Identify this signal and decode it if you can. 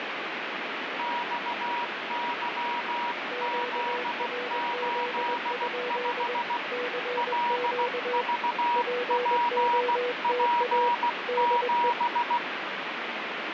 Morse code, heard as two keyed tones, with heavy radio static. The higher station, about 16 wpm, 960 Hz: XYZ85 LVPP7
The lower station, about 21 wpm, 490 Hz: QRZ? CQ POTA DE